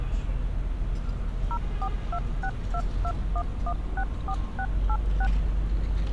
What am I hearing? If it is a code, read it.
DTMF, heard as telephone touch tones, dialled by machine, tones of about 60 ms, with street noise. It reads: 0426221164686